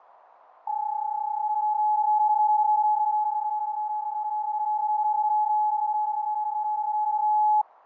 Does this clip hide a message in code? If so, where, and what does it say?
Yes: PSK31 (31.25 baud) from 0.7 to 7.6 s, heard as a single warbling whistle, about 850 Hz, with radio static and fading.